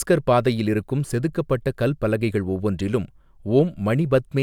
Speech in Tamil. There is no code.